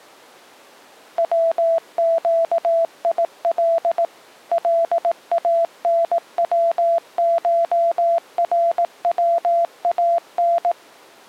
Morse code (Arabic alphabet), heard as a keyed tone, machine-sent, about 18 wpm, 670 Hz. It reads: وقيل لانوشروان